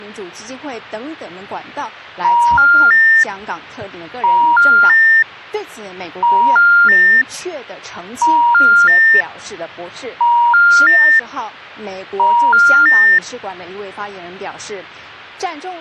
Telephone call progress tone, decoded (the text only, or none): special information tone